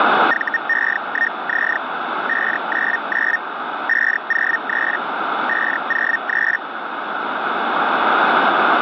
Hellschreiber (Feld-Hell, 122.5 baud), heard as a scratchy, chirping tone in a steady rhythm, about 1850 Hz, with radio static. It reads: VE1Z 599 503 503